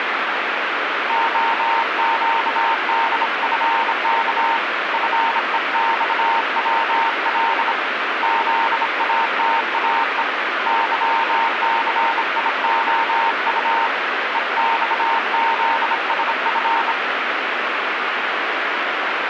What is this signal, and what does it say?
Morse code, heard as a keyed tone, hand-sent with a bug key, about 26 wpm, 920 Hz, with radio static. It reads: OQDFK FEXWL ZATAE YCIOU EXZSF